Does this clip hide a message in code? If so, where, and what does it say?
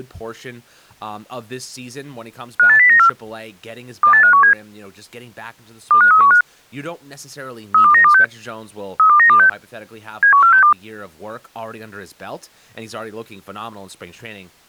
Yes: five-tone selective call (CCIR) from 2.6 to 10.7 s, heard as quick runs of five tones, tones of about 100 ms, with speech in English. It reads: 58094 28517 25315 32926 32926 71462